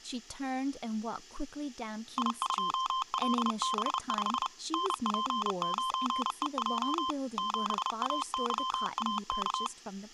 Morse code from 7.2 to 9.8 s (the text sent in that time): 7AYAK